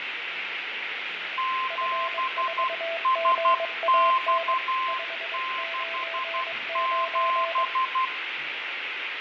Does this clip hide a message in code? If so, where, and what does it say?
Yes: Morse code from 1.3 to 8.1 s, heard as two keyed tones, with radio static, fading, room echo and the noise of a cafe. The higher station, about 12 wpm, 1040 Hz: 7SX67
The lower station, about 22 wpm, 660 Hz: F4GAN 599